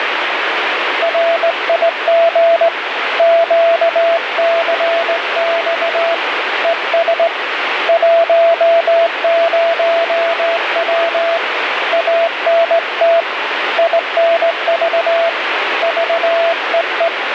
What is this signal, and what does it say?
Morse code, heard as a keyed tone, hand-sent with a straight key, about 18 wpm, 670 Hz, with radio static. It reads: RIG QCX ES 10W ANT INV VEE